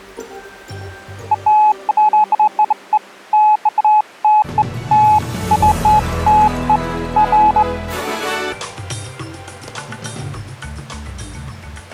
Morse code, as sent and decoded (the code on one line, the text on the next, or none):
none